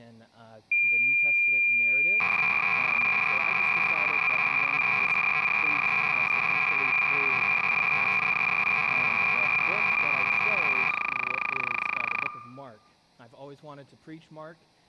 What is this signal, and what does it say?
Cassette data (Kansas City type), 300 baud, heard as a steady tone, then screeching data.